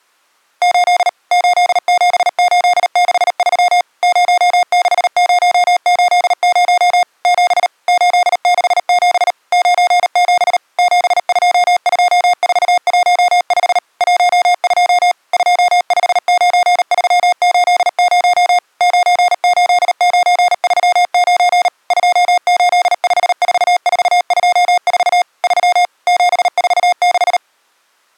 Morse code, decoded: 8 87863 06080 7 867 97 722415 12 259380 98939 2854424 3 746

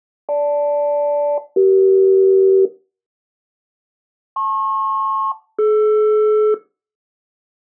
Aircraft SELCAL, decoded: GL-CE LP-DR

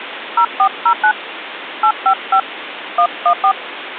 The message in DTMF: 0409 855 114

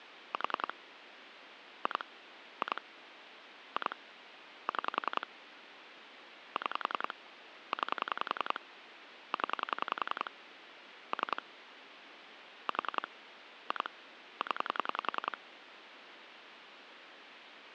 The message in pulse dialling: 4 2 2 2 6 6 9 0 3 4 2 0

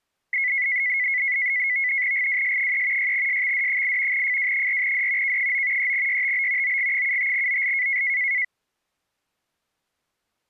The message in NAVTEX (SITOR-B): GWS3 6SXD8 FW4D K9 3YTB OG75OL

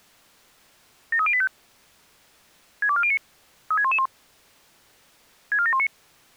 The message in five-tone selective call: 73085 62409 36111 64719

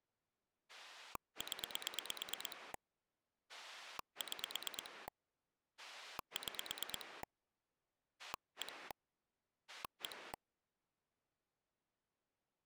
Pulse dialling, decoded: 0 6 6 1 1

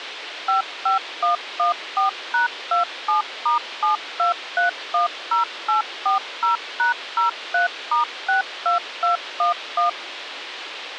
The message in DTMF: 55114#27*72310840#03*62211

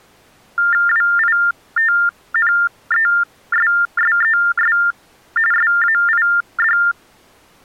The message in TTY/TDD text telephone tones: WITNESSES SAID

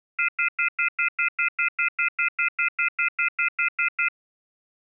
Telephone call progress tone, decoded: off-hook warning tone

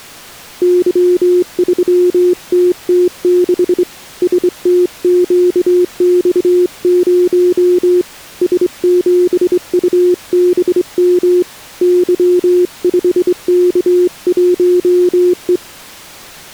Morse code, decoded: Y3TT6 STQX0 S7UBM Y5K1E

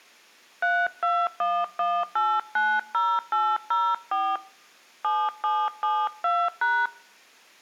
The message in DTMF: 3211890804 7772#

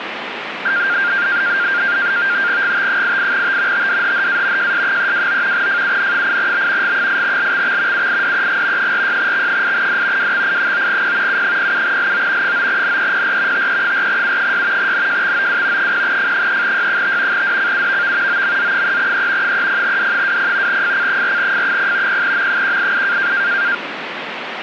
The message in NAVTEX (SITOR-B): GT88T TDHHA JS329 FUN8B G8LXX UIDEG 46X8D WXI9P U07LO 9NEPR TE4U6 NJXOW 0F3Y5 DCUVV OMZ3E 30D20 FC4F0 0M188

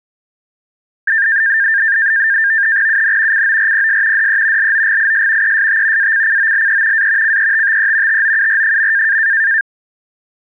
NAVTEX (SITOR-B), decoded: UN CORPS DE LOGIS EST ACCOLE A CETTE TOUR.

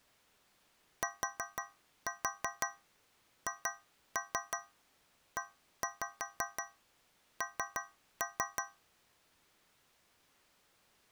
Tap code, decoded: THEN

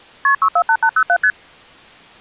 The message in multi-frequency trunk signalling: KP 648807 ST

